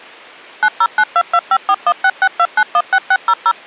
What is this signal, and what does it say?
DTMF, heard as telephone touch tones, dialled by machine, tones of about 60 ms. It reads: 90922541662916600